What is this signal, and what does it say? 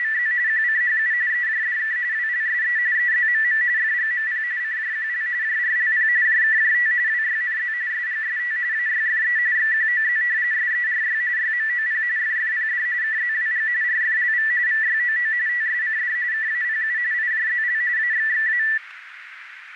RTTY (45.45 baud, 170 Hz shift), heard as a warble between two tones, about 1850 Hz centre, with radio static and a narrow filter. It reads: … QCHU EJDK WLSE EZMM FGMP CJQL JRLP JKJT WYNZ SGST AYFE XQOZ SERY YMOP FFPD KZWG RFLV VYOO TSCD KAPU IJZL AXXA